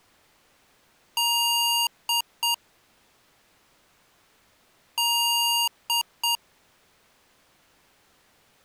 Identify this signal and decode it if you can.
Beep code, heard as beeps from a small speaker, played twice, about 940 Hz. 1 long, 2 short. In Award, IBM and AMI BIOS tables: video adapter failure.